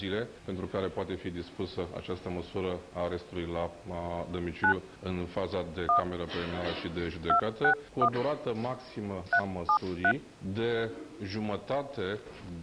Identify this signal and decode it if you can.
DTMF, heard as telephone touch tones, dialled by hand, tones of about 90 ms. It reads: 9 1 261 373